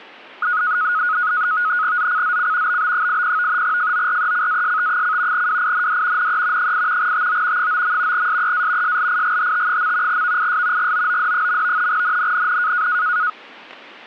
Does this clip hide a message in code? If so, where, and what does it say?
Yes: NAVTEX (SITOR-B), 100 baud, 170 Hz shift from 0.4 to 13.3 s, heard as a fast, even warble, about 1360 Hz centre. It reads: ZCZC BB80 FORECAST: WIND NE 8 TO 9. SEA SLIGHT. VIS GOOD. NNNN